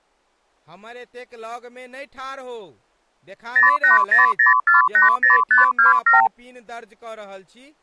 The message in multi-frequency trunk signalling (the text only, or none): 0800480527